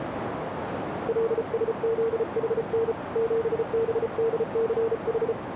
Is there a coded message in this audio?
Yes: Morse code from 1.0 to 5.4 s, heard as a keyed tone, hand-sent with a paddle, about 34 wpm, 450 Hz, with radio static and a narrow filter. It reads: LSZHN 7BDCH